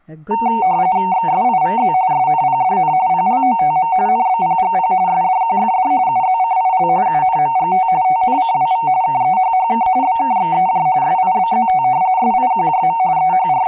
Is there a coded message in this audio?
Yes: RTTY (45.45 baud, 170 Hz shift) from 0.3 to 13.7 s, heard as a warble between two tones, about 830 Hz centre, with room echo and speech in English. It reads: XSIVZ SNPDN PLOTM NBPGP SDQFD UZCIL UNMGT TNCWV KEHHK BKXEJ SIBZT SIQJM …